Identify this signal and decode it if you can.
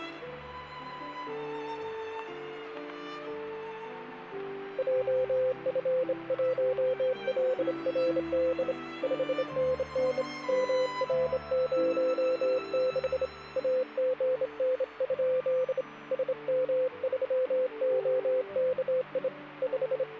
Morse code, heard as a keyed tone, hand-sent with a straight key, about 26 wpm, 510 Hz. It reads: JF1LRD 5NN MR06 AGN? SM3OKI …